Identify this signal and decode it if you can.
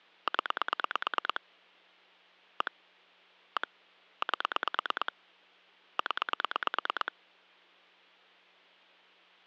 Pulse dialling, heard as clicks on a phone line, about 9 pulses a second. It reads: 0 1 1 8 0